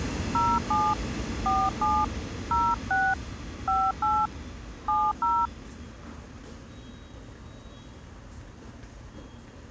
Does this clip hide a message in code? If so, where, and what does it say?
Yes: DTMF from 0.3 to 5.5 s, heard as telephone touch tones, dialled by hand, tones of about 240 ms, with the noise of a subway station. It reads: 07 47 06 58 70